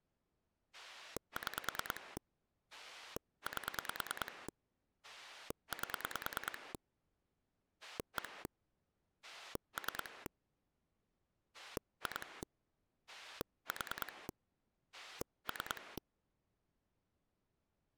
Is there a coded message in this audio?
Yes: pulse dialling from 0.7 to 16.0 s, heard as a rotary dial, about 9 pulses a second. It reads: 6 8 8 1 3 2 4 3